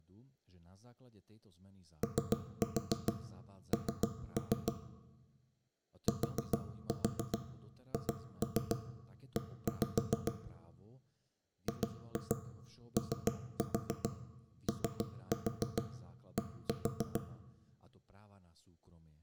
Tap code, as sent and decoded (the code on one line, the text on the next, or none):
3-4 3-3 / 4-4 2-3 1-5 / 2-2 3-4 3-4 1-4
ON THE GOOD